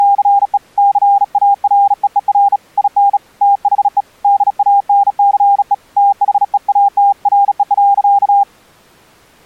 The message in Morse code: … CAREER IN THE DANCE THEATRE.

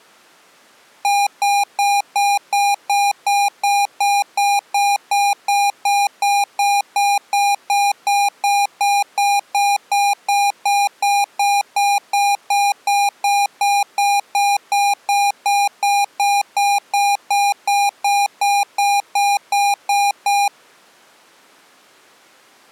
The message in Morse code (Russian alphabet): none

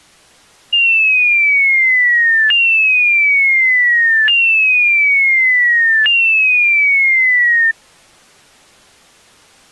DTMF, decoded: none

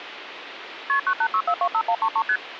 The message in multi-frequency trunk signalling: KP 986425133 ST

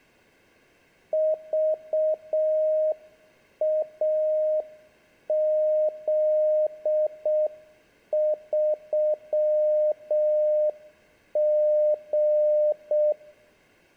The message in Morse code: VAZ3G

